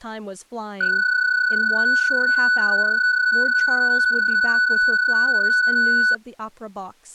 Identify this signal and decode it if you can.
PSK31 (31.25 baud), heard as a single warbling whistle, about 1490 Hz, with speech in English.